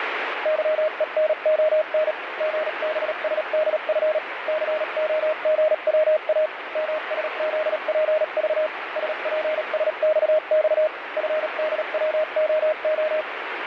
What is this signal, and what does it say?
Morse code, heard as a keyed tone, machine-sent, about 37 wpm, spaced as for 33 wpm, 620 Hz, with radio static. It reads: YENON GBSDF COGWA MSZPV SPSXX FDWOO